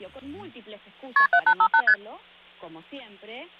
Multi-frequency trunk signalling (R1, as on North American trunks), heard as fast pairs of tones, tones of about 70 ms, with hum. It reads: KP 7858 ST